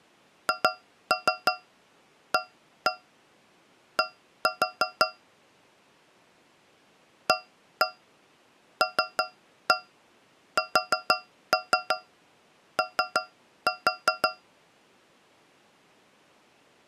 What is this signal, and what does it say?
Tap code, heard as taps on a metal pipe, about 6 knocks a second. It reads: HAD ALSO